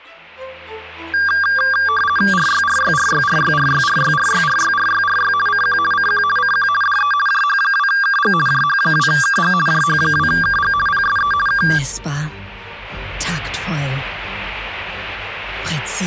RTTY (50 baud, 450 Hz shift), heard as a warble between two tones, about 1380 Hz centre. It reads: RYRYRYRYRYRYRYRYRYRY CQ CQ CQ DE JH2KG JH2KG JH2KG PSE K